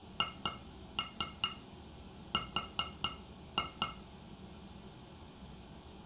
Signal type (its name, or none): tap code